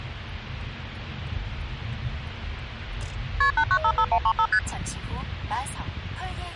Multi-frequency trunk signalling (R1, as on North American trunks), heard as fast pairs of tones, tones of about 70 ms, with hum and the noise inside a car. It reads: KP 8955135 ST